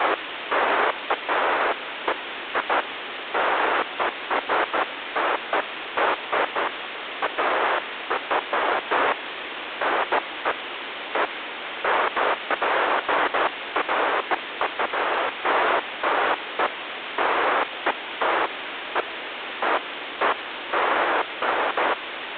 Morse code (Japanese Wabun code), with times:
none

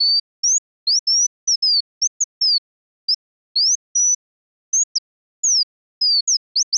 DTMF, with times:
none

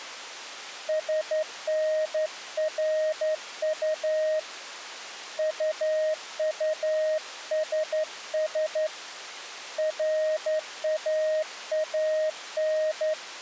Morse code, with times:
0.9-4.4 SNRU
5.4-8.9 UUSS
9.8-13.1 RAAN

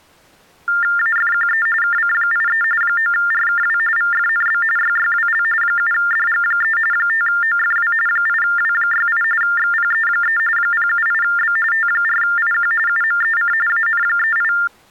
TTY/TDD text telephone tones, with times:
1.0-1.7 AFQE
1.8-2.6 KC83
2.8-3.8 9RKW
4.0-4.6 VFNB
4.8-5.4 YYWL
5.6-6.8 7DG3
6.9-7.9 5OFW
8.1-9.2 8W68
9.4-10.4 XPE3
10.6-11.6 078B
11.7-12.7 T4IQ
12.9-13.5 UMEC
13.7-14.5 AN38

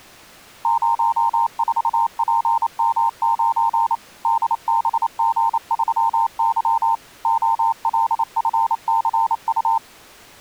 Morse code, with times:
0.7-4.0 04PM9
4.3-7.0 DBG3Y
7.3-9.8 OLFCU

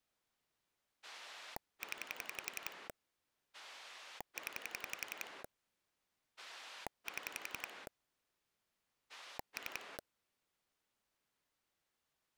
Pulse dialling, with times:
1.0-2.9 0
3.5-5.4 0
6.4-7.9 7
9.1-10.0 3

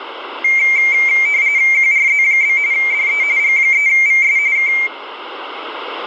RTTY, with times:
1.7-2.6 QRZ?
2.7-3.2 DE
3.4-4.4 G3VS
4.6-4.7 K

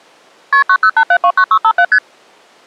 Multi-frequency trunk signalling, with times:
0.5-0.6 KP
0.7-1.8 908729657
1.9-2.0 ST

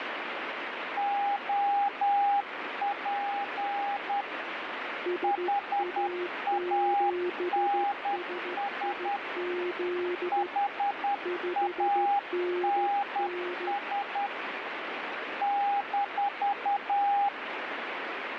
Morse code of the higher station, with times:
1.0-4.2 OP
5.2-9.2 HANS
10.3-14.3 HANS
15.4-17.3 -

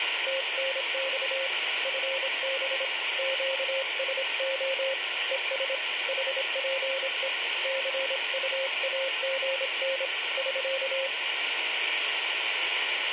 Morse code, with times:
0.3-1.5 TNX
1.8-2.8 FB
3.2-4.9 QSO
5.3-5.7 ES
6.1-7.3 HPE
7.6-10.1 CUAGN
10.4-11.1 <SK>

